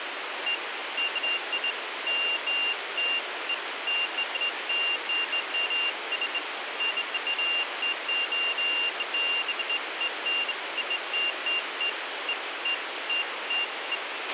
Beeps of irregular length, with radio hiss and a squelch burst at the end. There is no code.